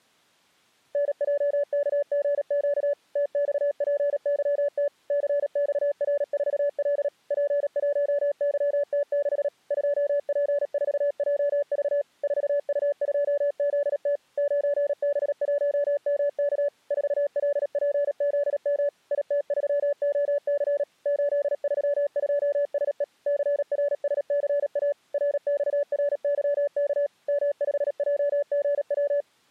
Morse code, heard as a keyed tone, machine-sent, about 37 wpm, 570 Hz. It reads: NJKGQ TXPYT CXR4L P1YT6 2P4JV 4U2ZT 9B1MK 4LPZM IT3OC 832SE CRSCA RXRYK M5JGW